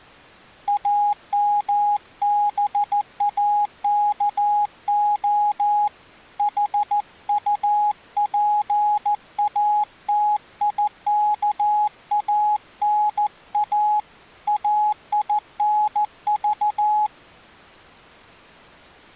Morse code, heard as a keyed tone, hand-sent with a paddle, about 14 wpm, 840 Hz. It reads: AMBAKO HUPATIKANA AINV